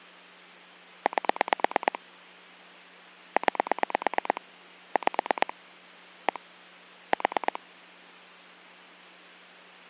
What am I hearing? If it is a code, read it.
Pulse dialling, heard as clicks on a phone line, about 9 pulses a second. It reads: 8 9 5 1 4